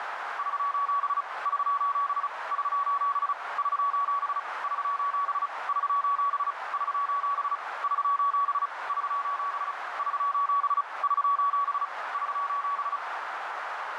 Morse code, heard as a keyed tone, hand-sent with a paddle, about 35 wpm, 1130 Hz, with radio static and a narrow filter. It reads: <SOS> <SOS> <SOS> <SOS> <SOS> <SOS> <SOS> <SOS> <SOS> <SOS> <SOS> <SOS>